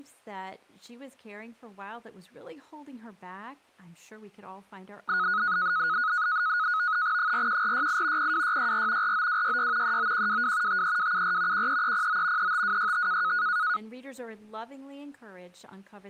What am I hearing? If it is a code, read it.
NAVTEX (SITOR-B), 100 baud, 170 Hz shift, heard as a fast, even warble, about 1360 Hz centre, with speech in English. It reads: 41468 02664 49266 39122 53274 13309 35265